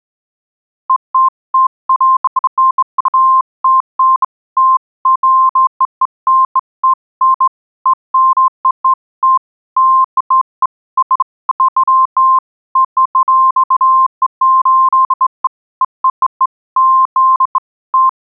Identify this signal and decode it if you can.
Beeps of irregular length. There is no code.